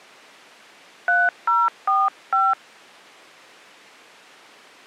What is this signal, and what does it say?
DTMF, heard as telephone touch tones, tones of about 210 ms. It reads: 3045